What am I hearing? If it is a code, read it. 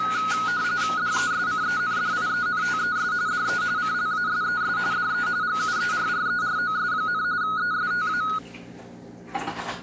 RTTY (45.45 baud, 170 Hz shift), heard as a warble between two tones, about 1360 Hz centre, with kitchen noise. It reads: DESCENDIENTES DE CLASES DE GUERREROS, ESTA